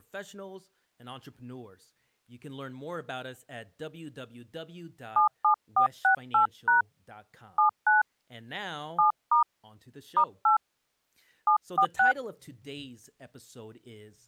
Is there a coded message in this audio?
Yes: DTMF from 5.2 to 12.1 s, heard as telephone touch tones, dialled by hand, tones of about 120 ms, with speech in English. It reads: 77468# 79 7* *8 746